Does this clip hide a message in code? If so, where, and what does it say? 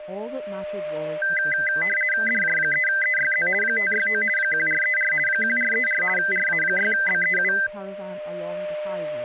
Yes: RTTY (50 baud, 450 Hz shift) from 1.2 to 7.7 s, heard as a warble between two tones, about 1800 Hz centre, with static crashes, a steady whistle near 600 Hz and speech in English. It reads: DJ3EYZ 569 1434 1434 RA6BEU